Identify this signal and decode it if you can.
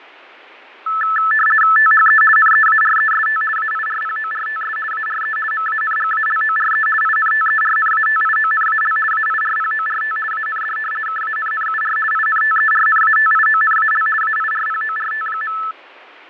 RTTY (50 baud, 450 Hz shift), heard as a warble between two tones, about 1550 Hz centre, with radio static and fading. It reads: THE NEAREST AIRPORTS ARE MANGALORE INTERNATIONAL AIRPORT AND KANNUR INTERNATIONAL AIRPORT.